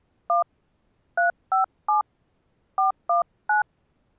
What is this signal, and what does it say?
DTMF, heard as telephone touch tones, dialled by hand, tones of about 130 ms. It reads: 1 357 419